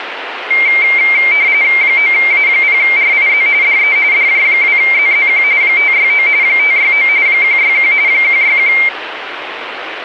RTTY (45.45 baud, 170 Hz shift), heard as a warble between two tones, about 2200 Hz centre, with radio static. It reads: 9A0RIZ DE DJ2ZZQ 569 569 161 161